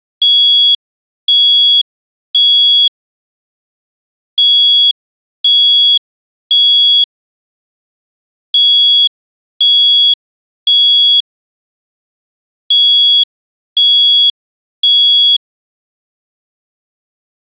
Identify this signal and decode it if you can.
Alarm pattern, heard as an alarm's beeps, played four times, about 3350 Hz. Temporal three. Smoke or fire, evacuate.